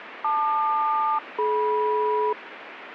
Aircraft SELCAL, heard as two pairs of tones, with radio static. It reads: LQ-DM